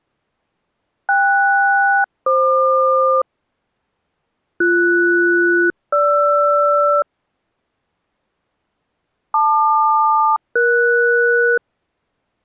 Aircraft SELCAL, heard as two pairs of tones. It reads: KS-FQ BS-GR LQ-ES